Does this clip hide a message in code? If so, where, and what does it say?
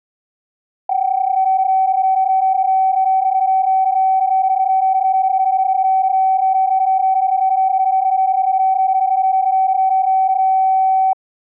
Yes: PSK31 (31.25 baud) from 0.9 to 11.1 s, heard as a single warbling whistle, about 760 Hz.